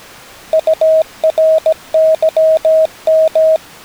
Morse code, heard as a keyed tone, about 17 wpm, 640 Hz. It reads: URYM